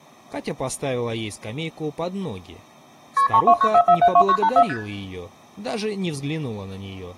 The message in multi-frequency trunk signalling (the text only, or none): KP 3294472984 ST